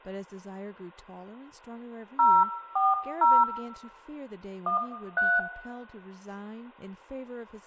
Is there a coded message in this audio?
Yes: DTMF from 2.2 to 5.4 s, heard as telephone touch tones, dialled by hand, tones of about 180 ms, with room echo and speech in English. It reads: 040 13